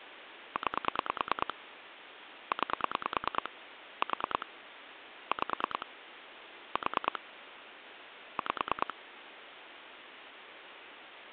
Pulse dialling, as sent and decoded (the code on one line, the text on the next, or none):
9 / 9 / 4 / 5 / 4 / 5
9 9 4 5 4 5